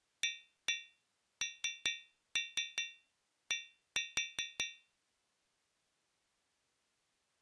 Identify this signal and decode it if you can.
Tap code, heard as taps on a metal pipe, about 5 knocks a second. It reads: AND